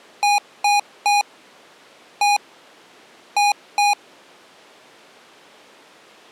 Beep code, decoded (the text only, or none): 3-1-2